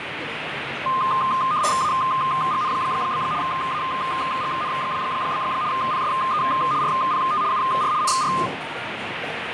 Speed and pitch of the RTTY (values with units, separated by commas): 75 baud, 170 Hz shift, 1140 Hz centre